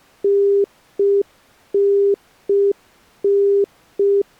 Telephone call progress tone (UK plan), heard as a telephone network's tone, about 400 Hz. Congestion tone.